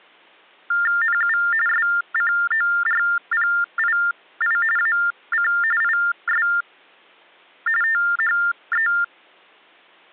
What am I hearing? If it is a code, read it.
TTY/TDD text telephone tones (45.45 baud Baudot), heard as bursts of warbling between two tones, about 400 Hz shift, 1600 Hz centre. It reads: NU SCORPII AC IS THE